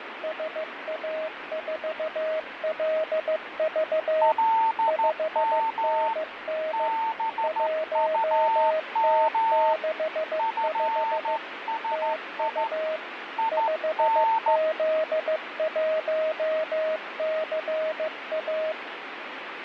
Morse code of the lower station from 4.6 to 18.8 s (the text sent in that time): 5NN 1T65 TU 5Z1CA